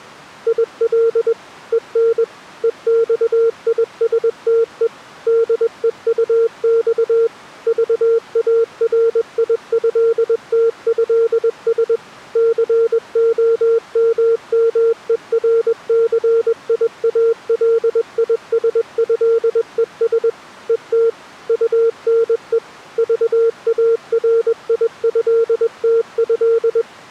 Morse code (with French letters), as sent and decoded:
.. .-.. / . -. / . -..- .. ... - . / -.. . ..- -..- / ...- .- .-. .. ..-.. - ..-.. ... / -.-. --- -- -- . .-. -.-. .. .- .-.. .. ... ..-.. . ... / . - / ..- -. . / ...- .- .-. .. ..-.. - ..-..
IL EN EXISTE DEUX VARIÉTÉS COMMERCIALISÉES ET UNE VARIÉTÉ

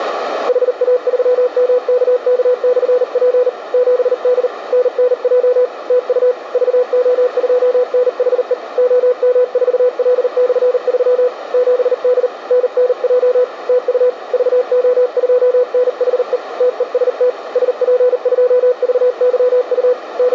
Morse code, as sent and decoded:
.... .- ...-- -- -.- -.- -..-. .--. / --... -.. / -. -. .--- / - ..- / ...- --- ..--- -. .... . / --- -- ....- .-.. -..-. ...-- / --... -.. / -. -. .--- / - ..- / ...- --- ..--- -. .... . / - . ... - / ... .--. ..--- ...- -.-- ..- / …
HA3MKK/P 7D NNJ TU VO2NHE OM4L/3 7D NNJ TU VO2NHE TEST SP2VYU …

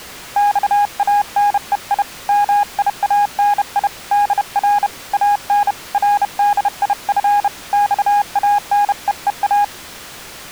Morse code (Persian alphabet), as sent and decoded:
-..- .- -. . .. / -- .. .- -. .. / -.. .-. / .- -. / .-. -.. .. ..-. / -..- .- -. . . .-
خانهی میانی در ان ردیف خانهها

